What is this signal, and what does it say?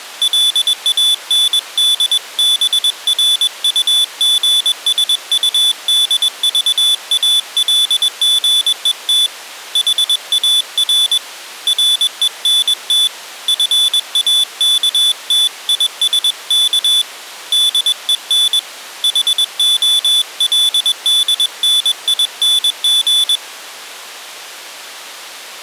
Morse code, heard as a high beeper, hand-sent with a paddle, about 21 wpm, 3450 Hz. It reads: LANDBRUGSUDVALGET HAR RENT FAKTISK DEN HOLDNING